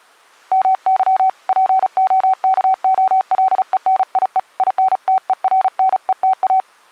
Morse code (Russian alphabet), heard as a keyed tone, hand-sent with a paddle, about 35 wpm, 760 Hz. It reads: МЫ ПОКОЛЕНИЕ ИНТЕРНЕТА